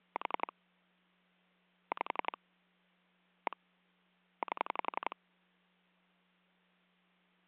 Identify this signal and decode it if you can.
Pulse dialling, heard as clicks on a phone line, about 11 pulses a second. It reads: 4 5 1 8